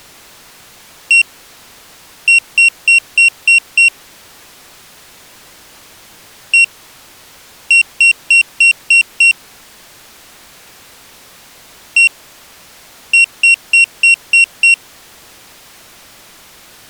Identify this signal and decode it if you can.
Beep code, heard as a piezo beeper, played three times, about 2750 Hz. 1-6.